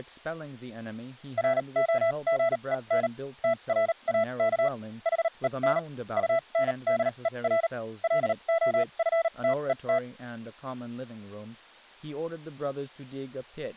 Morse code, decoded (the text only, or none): ROGEN TRAK HEN UNDER LOFTET